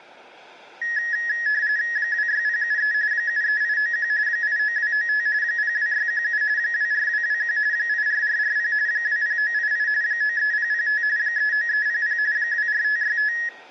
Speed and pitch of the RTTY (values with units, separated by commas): 45.45 baud, 170 Hz shift, 1800 Hz centre